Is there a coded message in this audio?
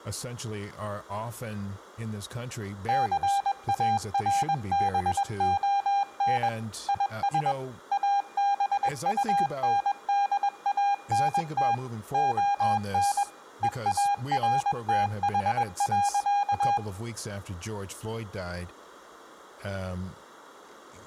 Yes: Morse code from 2.8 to 16.8 s, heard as a keyed tone, machine-sent, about 21 wpm, 800 Hz, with room echo and speech in English. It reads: CARBON IS ABUNDANT ON EARTH.